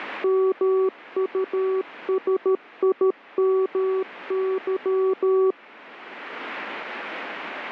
Morse code, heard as a keyed tone, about 13 wpm, 380 Hz. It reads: MUSIMY